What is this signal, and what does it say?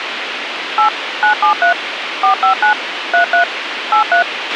DTMF, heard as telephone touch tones, dialled by machine, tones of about 110 ms, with radio hiss and a squelch burst at the end. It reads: 8 973 459 33 83